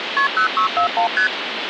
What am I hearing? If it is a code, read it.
Multi-frequency trunk signalling (R1, as on North American trunks), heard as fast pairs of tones, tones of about 100 ms, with phone line noise. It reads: KP 0641 ST